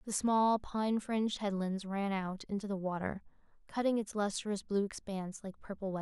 Speech in English. There is no code.